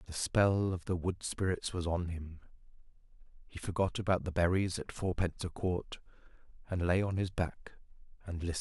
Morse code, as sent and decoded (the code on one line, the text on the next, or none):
none